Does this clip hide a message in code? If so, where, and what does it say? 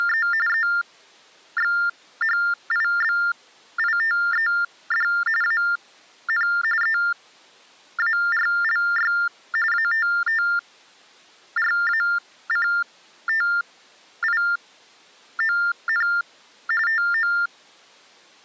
Yes: TTY/TDD text telephone tones (45.45 baud Baudot) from 0.0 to 17.5 s, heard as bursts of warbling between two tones, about 400 Hz shift, 1600 Hz centre. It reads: … EXHIBITED AN EARLY ATTRACTION TO